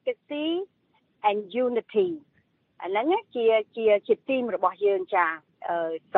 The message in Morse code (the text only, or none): none